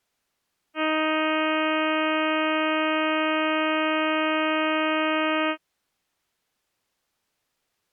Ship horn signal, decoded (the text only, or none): 1 long